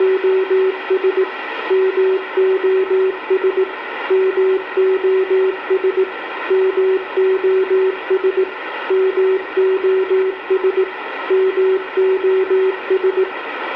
Morse code, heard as a keyed tone, machine-sent, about 18 wpm, 380 Hz, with radio static and room echo. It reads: … MOS MOS MOS MOS MOS